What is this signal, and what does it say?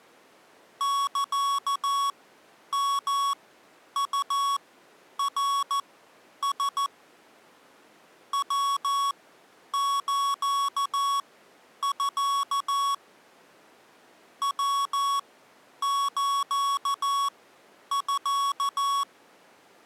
Morse code (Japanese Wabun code), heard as electronic beeps, machine-sent, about 14 wpm, spaced as for 9 wpm, 1120 Hz. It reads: サヨウナラ ヤスミ ヤスミ